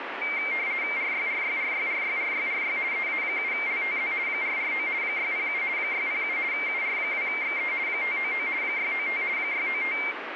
RTTY (50 baud, 170 Hz shift), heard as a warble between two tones, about 2200 Hz centre, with radio static. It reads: RYRYRYRYRYRY EA7LTZ 449 607 607 UR2XE 599 695 695